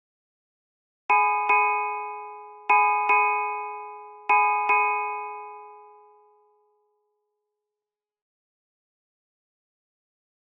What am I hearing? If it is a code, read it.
Ship's bell, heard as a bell, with room echo. 6. Six half-hours of the watch have passed.